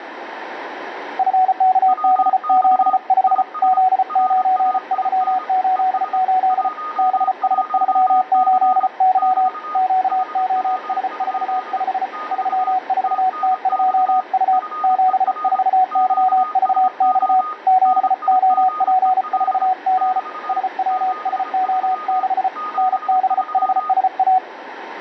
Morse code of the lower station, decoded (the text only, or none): FKB75 Z9388 BS38Y QOS45 34T2U 74YVX 7OP4G SWSO6 NBHSA